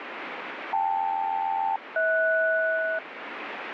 Aircraft SELCAL, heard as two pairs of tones, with radio static. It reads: KL-HS